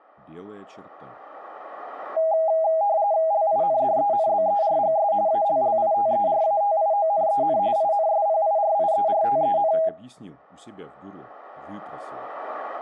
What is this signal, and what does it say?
RTTY (45.45 baud, 170 Hz shift), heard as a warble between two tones, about 730 Hz centre, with room echo. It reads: LINDENBERGS ALLITERATIONEN INSPIRIERTEN